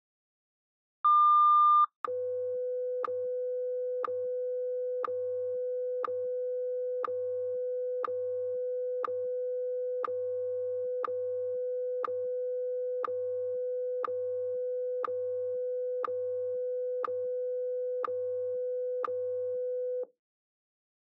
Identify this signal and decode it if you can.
Radio time signal (WWVH, Hawaii), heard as ticks, one a second.